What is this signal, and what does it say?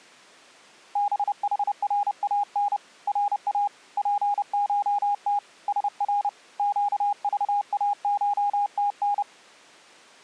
Morse code (Persian alphabet), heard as a keyed tone, hand-sent with a paddle, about 30 wpm, 820 Hz. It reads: بحران را پشت سر گذاشتن